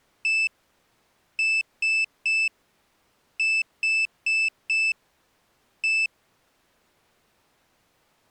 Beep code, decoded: 1-3-4-1

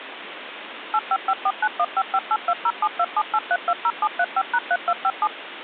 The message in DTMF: 855491558207278320735#3257

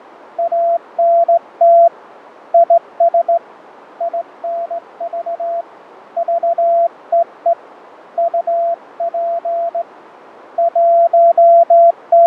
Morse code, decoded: ANT IS INV VEE UP …

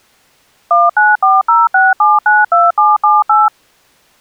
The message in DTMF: 19406792778

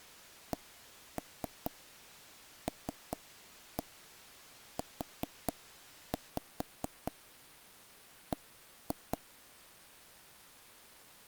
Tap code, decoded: CLUB

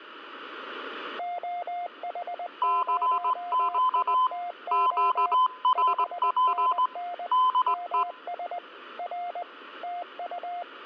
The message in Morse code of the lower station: OH0ITO 5NN MS R TU

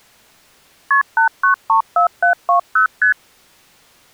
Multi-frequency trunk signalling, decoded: KP 8934720 ST

